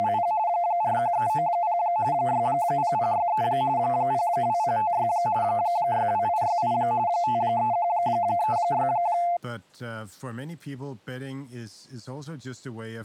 RTTY (45.45 baud, 170 Hz shift), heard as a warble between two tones, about 780 Hz centre, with speech in Danish. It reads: … 41390 60063 02056 62868 53136